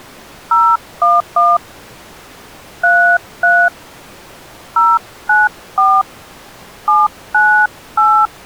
DTMF, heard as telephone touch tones, dialled by hand, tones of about 270 ms. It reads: 011 33 094 798